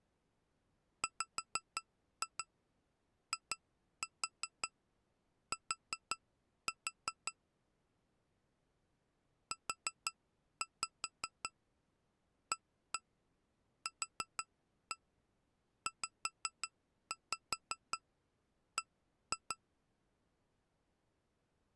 Tap code, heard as taps on glass, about 5 knocks a second. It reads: WIT UAQZB